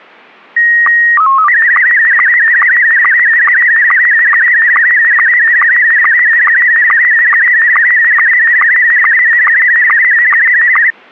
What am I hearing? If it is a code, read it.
SSTV (slow-scan television), Scottie S1, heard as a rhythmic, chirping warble.